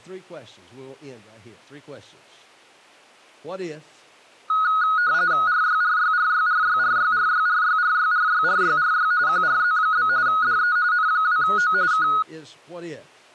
RTTY (45.45 baud, 170 Hz shift), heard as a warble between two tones, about 1360 Hz centre, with speech in English. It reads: RYRYRYRYRYRYRYRYRYRYRY QRZ? DE N2O K